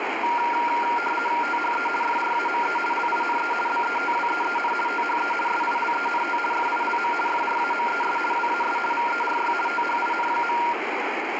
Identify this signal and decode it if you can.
RTTY (50 baud, 450 Hz shift), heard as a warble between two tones, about 1170 Hz centre, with radio static. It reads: THE FRAME LINE BETWEEN THE SILENT FILM FRAMES WAS VERY THIN.